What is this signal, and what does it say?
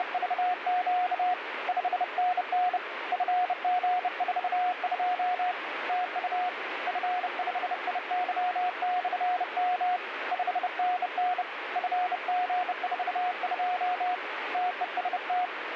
Morse code, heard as a keyed tone, hand-sent with a bug key, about 30 wpm, 720 Hz, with radio static. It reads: … 5NN FG42 TU F5IY/M 5NN FG42 TEST